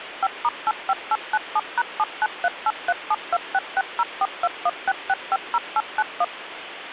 DTMF, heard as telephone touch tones, dialled by machine, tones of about 40 ms, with phone line noise. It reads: 5*85897#79383726604216650891